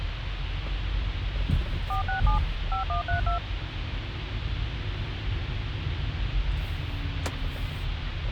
DTMF, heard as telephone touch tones, dialled by machine, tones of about 120 ms, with phone line noise and the noise inside a car. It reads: 467 5132